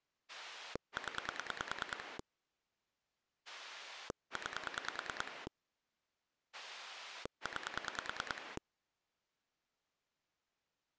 Pulse dialling, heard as a rotary dial, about 9 pulses a second. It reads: 0 9 9